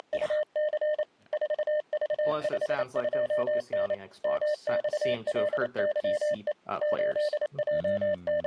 Morse code, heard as a keyed tone, machine-sent, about 28 wpm, 600 Hz, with speech in English. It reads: … 4V52N MXLYE …